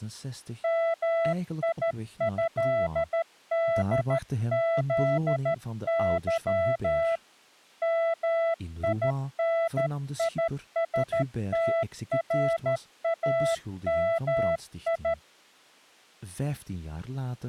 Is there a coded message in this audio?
Yes: Morse code (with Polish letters) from 0.6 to 15.2 s, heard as a keyed tone, hand-sent with a straight key, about 13 wpm, 660 Hz, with speech in Dutch. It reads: MIĘDZY MINISTRAMI